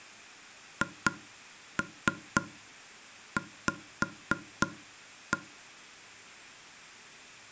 Tap code, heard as taps on a table, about 3 knocks a second. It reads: HV